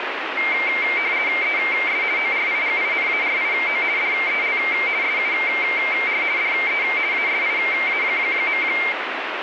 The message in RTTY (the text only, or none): ES ORIGINARIO DEL SUR DE ASIA.